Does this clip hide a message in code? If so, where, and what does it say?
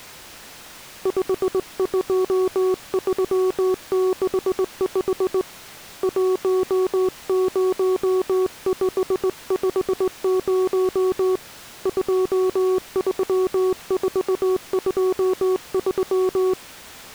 Yes: Morse code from 1.0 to 16.6 s, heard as a keyed tone, hand-sent with a straight key, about 19 wpm, 370 Hz. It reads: 52365 10550 23423